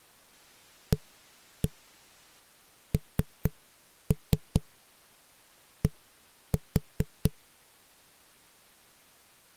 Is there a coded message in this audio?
Yes: tap code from 0.9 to 7.3 s, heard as knocks on a wall, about 4 knocks a second. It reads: AND